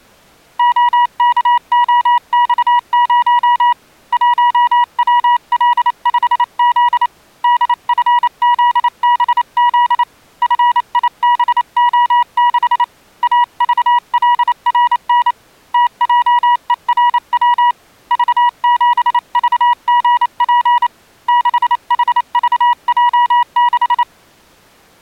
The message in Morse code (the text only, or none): OKOX0 1WL5Z DFZBZ FIBO6 AVLRN TJERW V7VGP 6HVJ6